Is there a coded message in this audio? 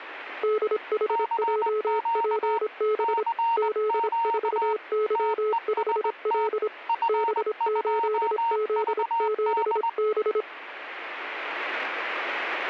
Yes: Morse code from 0.4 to 10.5 s, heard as two keyed tones. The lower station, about 26 wpm, 430 Hz: DHJPB Z4Y5L B8Z7B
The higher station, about 20 wpm, 920 Hz: CQ CQ TEST F2VD